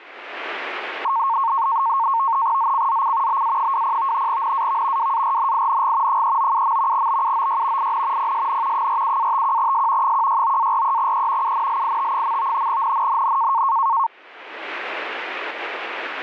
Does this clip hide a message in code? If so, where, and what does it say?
Yes: NAVTEX (SITOR-B), 100 baud, 170 Hz shift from 1.0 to 14.1 s, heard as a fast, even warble, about 1000 Hz centre. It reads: ZCZC BA20 NAV WARNING 397. BUOY IN PSN 47-51S 169-43E UNLIT. NNNN